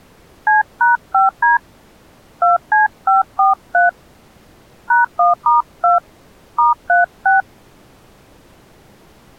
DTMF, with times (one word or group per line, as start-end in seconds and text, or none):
0.5-1.6 C#5D
2.4-3.9 2C543
4.9-6.0 #1*2
6.6-7.4 *36